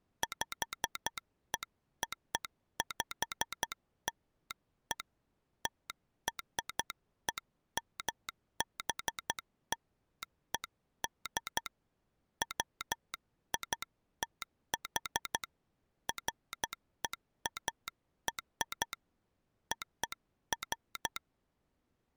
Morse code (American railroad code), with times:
0.2-5.0 PEOPLE
5.7-11.7 TREMBLED
12.4-15.4 WITH
16.1-18.9 FEAR
19.7-21.2 OF

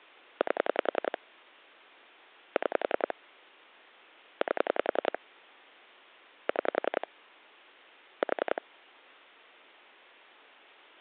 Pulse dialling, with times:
0.4-1.2 8
2.6-3.1 6
4.4-5.2 8
6.5-7.1 6
8.2-8.6 4

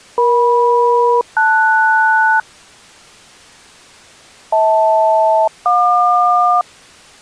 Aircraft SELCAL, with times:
0.2-2.4 EM-LS
4.5-6.6 HL-JQ

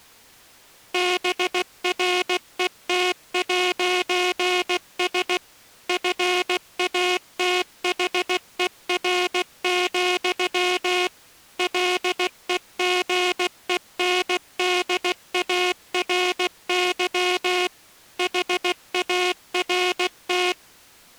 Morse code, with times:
0.9-5.4 BRET'S
5.9-11.1 FATHER,
11.6-17.7 LEGENDARY
18.2-20.5 HART

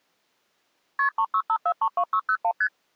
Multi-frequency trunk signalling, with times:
1.0-1.1 KP
1.2-2.5 365432601
2.6-2.7 ST

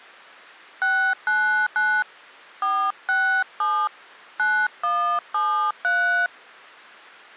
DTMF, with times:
0.8-2.0 699
2.6-3.9 467
4.4-6.3 9173

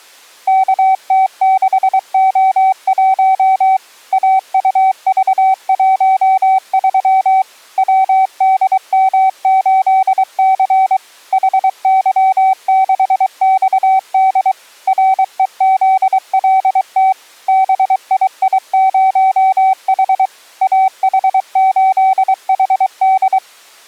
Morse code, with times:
0.5-3.8 KT6O1
4.1-7.4 AUV13
7.8-11.0 WDM8C
11.3-14.5 HY6XD
14.9-17.1 REZLT
17.5-20.3 BII0H
20.6-23.4 AH8HD

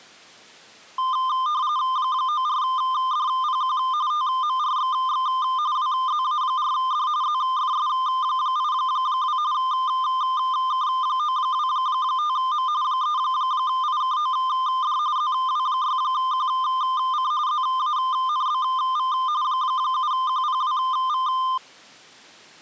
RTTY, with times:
2.0-3.8 94DPQ
4.1-5.3 TMRXX
5.8-7.1 WZA4D
7.2-9.4 ZFS82
9.5-12.7 K925M
12.8-15.0 3IKOD
15.2-17.3 ZW6QC
17.5-19.1 ZANBV
19.4-21.3 7QPWV

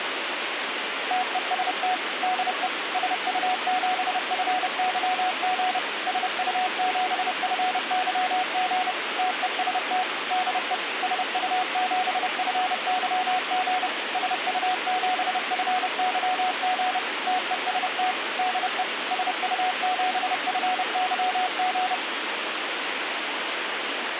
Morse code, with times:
1.1-1.9 TEST
2.2-2.7 DE
2.9-5.8 SU7FYG
6.1-8.9 SU7FYG
9.2-10.0 TEST
10.3-10.7 DE
11.0-13.9 SU7FYG
14.1-17.0 SU7FYG
17.3-18.1 TEST
18.4-18.8 DE
19.1-21.9 SU7FYG

